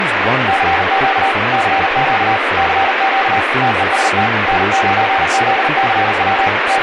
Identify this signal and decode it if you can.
Morse code, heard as a keyed tone, machine-sent, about 39 wpm, 780 Hz, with heavy radio static and speech in English. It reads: CQ CQ CQ TEST N9ZCW …